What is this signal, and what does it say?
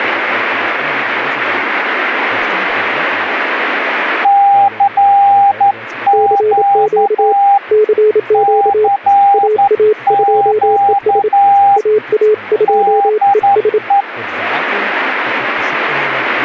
Morse code, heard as two keyed tones, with speech in German. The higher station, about 11 wpm, 800 Hz: CQ CQ DE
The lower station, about 27 wpm, 430 Hz: CQ CQ AA2ES AA2ES